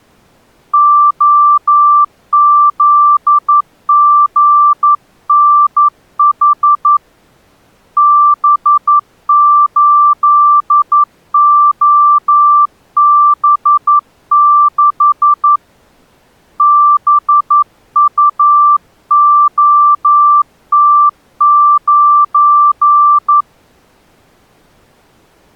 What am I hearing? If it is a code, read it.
Morse code, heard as a keyed tone, hand-sent with a paddle, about 11 wpm, 1170 Hz. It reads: OZGNH B8OB6 BUOT9